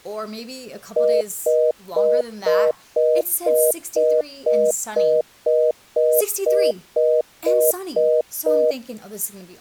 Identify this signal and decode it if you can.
Telephone call progress tone (North American plan), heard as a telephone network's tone, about 480, 620 Hz, 0.25 s on and 0.25 s off, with speech in English. Congestion tone.